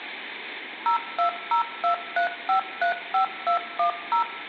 DTMF, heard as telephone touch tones, dialled by machine, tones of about 110 ms, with phone line noise and room echo. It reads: 02023535210